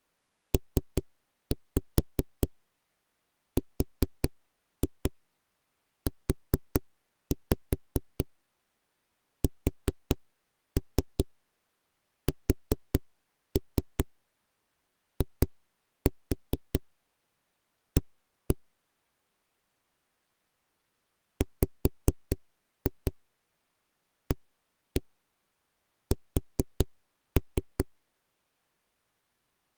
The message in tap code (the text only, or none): PRUSSIA WAS